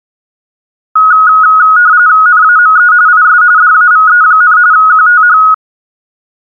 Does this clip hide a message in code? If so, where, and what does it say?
Yes: RTTY (45.45 baud, 170 Hz shift) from 1.0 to 5.5 s, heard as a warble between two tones, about 1360 Hz centre. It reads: NAME IS DAVE, QTH